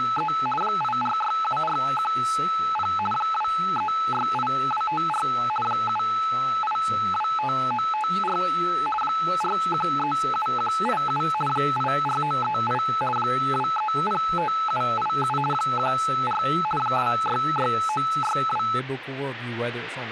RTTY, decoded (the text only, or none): … 8467410 2368254 7825954 4137187 84938 2305787 14 266962